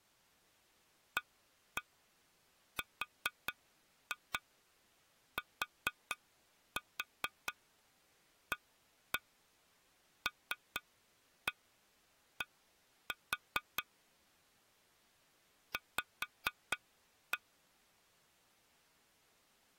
Tap code, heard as taps on glass, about 4 knocks a second. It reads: ARTALD V